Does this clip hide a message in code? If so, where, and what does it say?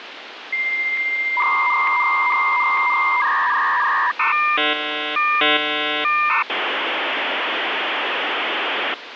Yes: dial-up modem handshake (V.34 or later) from 0.5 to 8.9 s, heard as a whistle, warbles, then hiss, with phone line noise.